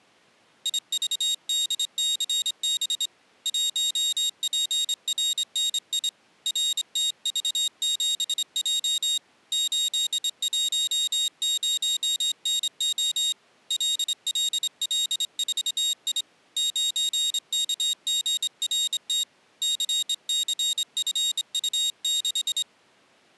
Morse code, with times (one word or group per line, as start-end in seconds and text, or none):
0.7-3.1 IVDCB
3.5-6.1 1PRNI
6.5-9.2 RTV7J
9.5-13.3 810NO
13.7-16.2 LLL4I
16.6-19.2 9KGRT
19.6-22.6 CCFU6